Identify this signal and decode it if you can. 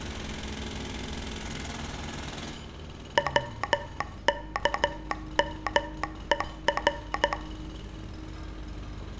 Morse code, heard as a telegraph sounder, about 13 wpm, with room echo and street noise. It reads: WKMER